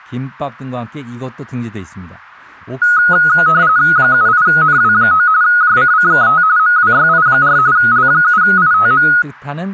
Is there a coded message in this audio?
Yes: RTTY (45.45 baud, 170 Hz shift) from 2.8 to 9.2 s, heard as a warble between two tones, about 1360 Hz centre, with speech in Korean. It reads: 78NW9 JCCKT MWYI4 L7ITM